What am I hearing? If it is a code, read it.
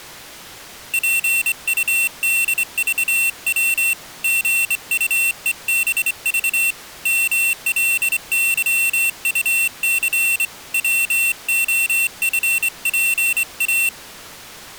Morse code, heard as a high beeper, hand-sent with a straight key, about 25 wpm, 2700 Hz. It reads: PUDVW GUEBV MLYUC WOFPA